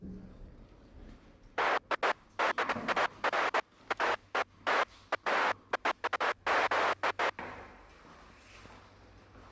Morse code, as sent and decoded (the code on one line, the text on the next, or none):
none